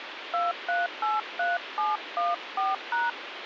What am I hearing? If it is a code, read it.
DTMF, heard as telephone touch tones, dialled by hand, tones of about 180 ms, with phone line noise. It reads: 2383714#